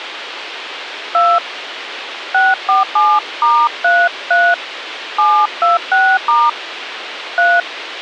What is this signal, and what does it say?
DTMF, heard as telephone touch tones, dialled by hand, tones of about 210 ms, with radio hiss. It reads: 2 647*33 726* 3